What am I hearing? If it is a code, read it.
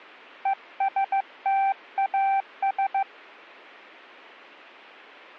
Morse code, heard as a keyed tone, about 15 wpm, 780 Hz, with radio static. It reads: ESTAS